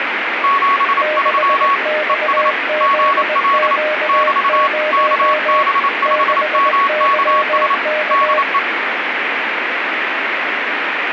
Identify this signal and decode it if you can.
Morse code, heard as two keyed tones, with radio static. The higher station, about 28 wpm, 1110 Hz: 73 ES GL <BT> KB5MKS DE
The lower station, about 20 wpm, 610 Hz: 6XZQ0 6YK